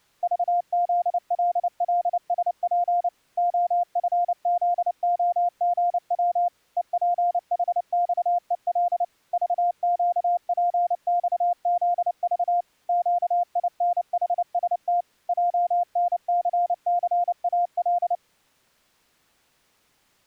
Morse code, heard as a keyed tone, machine-sent, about 29 wpm, 700 Hz. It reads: VZLLSP OFZOGW EPHXEL VQPXZV QINHST JNCCAL